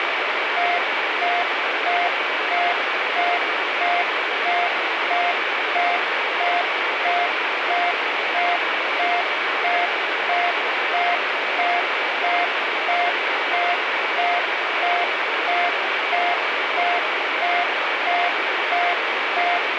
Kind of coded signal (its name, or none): none